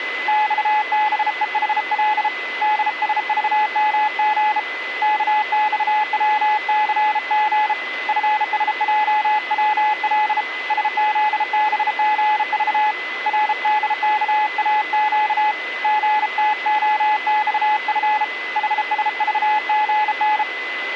Morse code, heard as a keyed tone, hand-sent with a bug key, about 33 wpm, 850 Hz, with radio static and a steady whistle near 2020 Hz. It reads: XBEHL DSVMG KXWCG FSJWL SZBGV RDKAQ GTOXF HSVGN